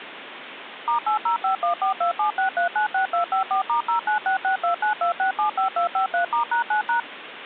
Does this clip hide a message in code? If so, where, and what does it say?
Yes: DTMF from 0.9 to 7.0 s, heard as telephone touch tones, dialled by machine, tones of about 110 ms, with phone line noise. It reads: *80514276396254*0966292675253*#9#